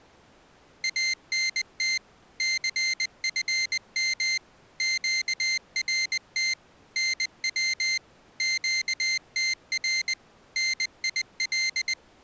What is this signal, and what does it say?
Morse code, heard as a high beeper, machine-sent, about 20 wpm, 2100 Hz. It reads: ANT CFM QRT NW QTR NIL